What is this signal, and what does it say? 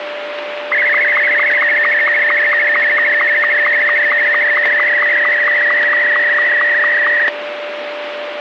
SSTV (slow-scan television), Martin M2, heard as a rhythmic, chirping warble, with radio static and a steady whistle near 590 Hz.